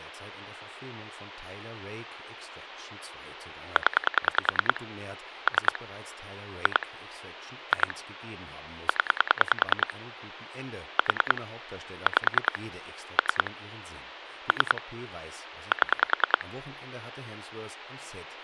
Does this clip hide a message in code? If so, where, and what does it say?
Yes: pulse dialling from 3.8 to 16.4 s, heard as clicks on a phone line, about 10 pulses a second, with phone line noise and speech in German. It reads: 0 3 2 2 0 4 5 3 3 7